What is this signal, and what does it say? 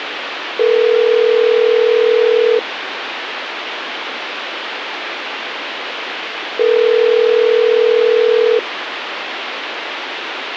Telephone call progress tone (North American plan), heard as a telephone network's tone, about 440, 480 Hz, 2 s on and 4 s off, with phone line noise. Ringback tone.